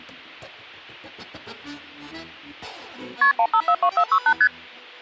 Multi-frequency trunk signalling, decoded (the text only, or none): KP 1542468 ST